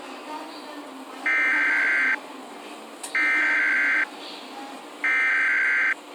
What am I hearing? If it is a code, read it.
Emergency Alert System (SAME) tones (header bursts), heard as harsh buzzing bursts, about 520.83 baud, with the noise inside a subway train.